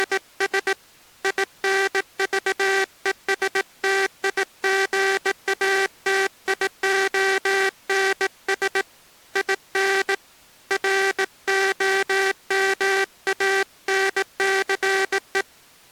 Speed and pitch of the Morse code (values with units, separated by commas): 18 wpm